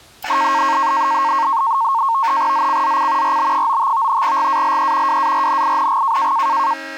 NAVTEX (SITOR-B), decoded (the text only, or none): ZCZC RB95 GALE WARNING